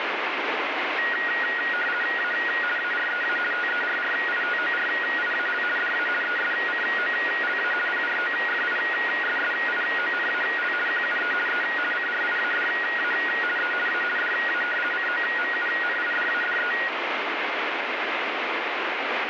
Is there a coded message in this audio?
Yes: RTTY (50 baud, 450 Hz shift) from 1.0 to 16.9 s, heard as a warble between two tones, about 1650 Hz centre, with radio static. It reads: A AREA TERRITORIAL DA ESCOLA PROFISSIONAL QUE E CRIADA E A DA COMUNIDADE